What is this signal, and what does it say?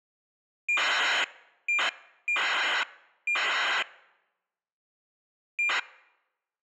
ACARS aircraft data, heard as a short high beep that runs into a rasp, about 2400 baud.